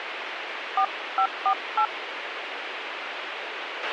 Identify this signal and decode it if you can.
DTMF, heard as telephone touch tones, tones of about 80 ms, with radio hiss and a squelch burst at the end. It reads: 4548